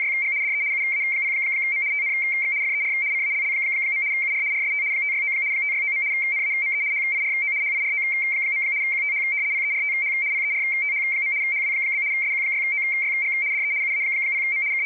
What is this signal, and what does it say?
RTTY (75 baud, 170 Hz shift), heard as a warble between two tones, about 2200 Hz centre. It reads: … DE UA0M TNX FER CALL. UR RST 569 569. NAME HIRO HIRO. QTH PERTH PERTH. HW? SQ6OYG DE UA0M …